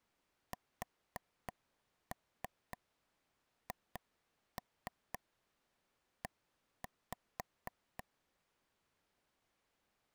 Tap code, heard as taps on a table, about 3 knocks a second. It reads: SHE